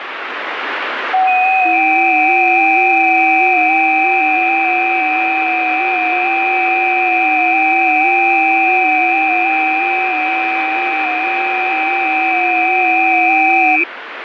FT8 (several signals at once), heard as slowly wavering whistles, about 6.25 baud, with radio static.